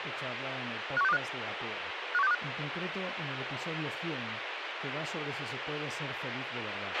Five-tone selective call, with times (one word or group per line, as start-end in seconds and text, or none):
1.0-1.2 51625
2.1-2.3 51625